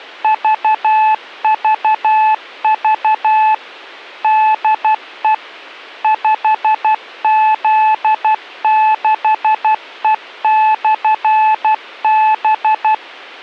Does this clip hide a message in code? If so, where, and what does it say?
Yes: Morse code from 0.2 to 13.0 s, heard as a keyed tone, machine-sent, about 12 wpm, 870 Hz. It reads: VVV DE 5Z6E/B